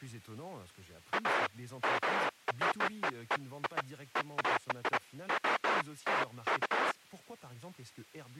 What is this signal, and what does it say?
Bursts of noise, with speech in French. There is no code.